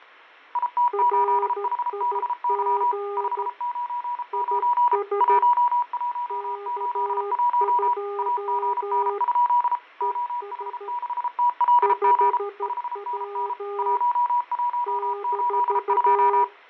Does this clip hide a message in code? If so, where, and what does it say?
Yes: Morse code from 0.5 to 16.5 s, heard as two keyed tones, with radio static and fading. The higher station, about 33 wpm, 970 Hz: IT8HBY 599 1181 AGN? OH6TLG 5NN 1182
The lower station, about 13 wpm, 400 Hz: RIG IS K2 ES 5W -